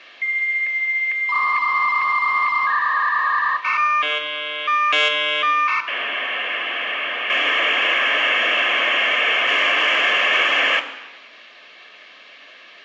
Dial-up modem handshake (V.34 or later), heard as a whistle, warbles, then hiss, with room echo.